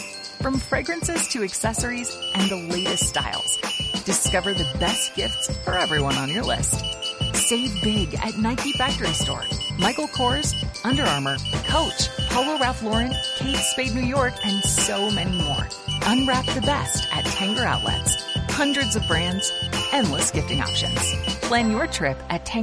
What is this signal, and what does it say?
Morse code, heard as a high beeper, machine-sent, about 13 wpm, 2950 Hz. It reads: TYJB3 7NXSW YL89L